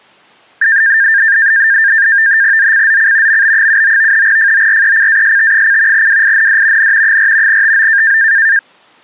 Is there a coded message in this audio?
Yes: NAVTEX (SITOR-B), 100 baud, 170 Hz shift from 0.6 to 8.6 s, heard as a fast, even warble, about 1700 Hz centre. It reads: ZCZC MB79 FORECAST: WIND N 4 TO